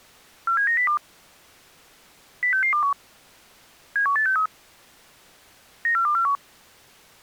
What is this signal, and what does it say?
Five-tone selective call (CCIR), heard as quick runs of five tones, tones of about 100 ms. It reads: 47902 06621 71863 94241